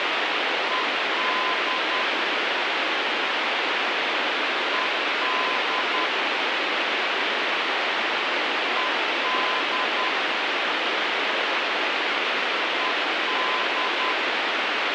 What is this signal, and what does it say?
Morse code, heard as a keyed tone, machine-sent, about 10 wpm, 1020 Hz, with heavy radio static. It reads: ED ED ED ED